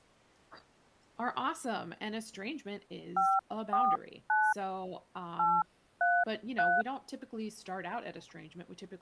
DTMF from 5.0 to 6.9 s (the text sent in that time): 833